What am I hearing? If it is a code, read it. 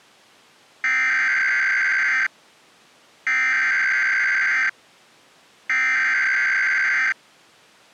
Emergency Alert System (SAME) tones (header bursts), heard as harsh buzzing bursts, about 520.83 baud.